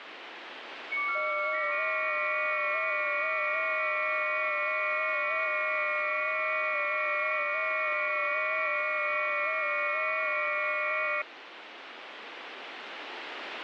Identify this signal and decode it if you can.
FT8 (several signals at once), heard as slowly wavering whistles, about 6.25 baud, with radio static.